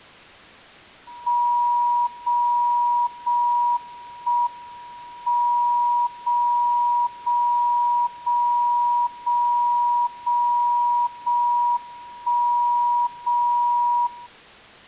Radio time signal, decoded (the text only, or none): 0 0 1 M 0 0 0 0 0 0 1 0 0